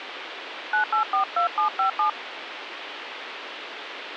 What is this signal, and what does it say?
DTMF, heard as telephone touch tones, dialled by hand, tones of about 110 ms, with phone line noise. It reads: 9842757